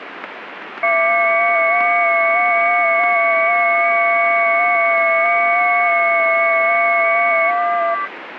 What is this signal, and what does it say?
FT8 (several signals at once), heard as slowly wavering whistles, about 6.25 baud, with radio static.